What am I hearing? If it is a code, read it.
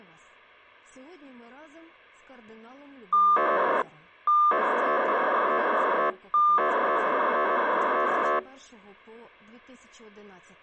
POCSAG pager data (2400 baud), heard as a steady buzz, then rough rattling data.